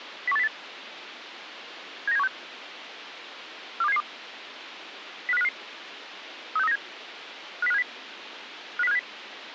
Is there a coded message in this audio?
Yes: five-tone selective call (EEA) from 0.3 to 9.0 s, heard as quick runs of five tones, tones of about 40 ms, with radio hiss. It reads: 01808 79716 42772 05055 36397 50570 50570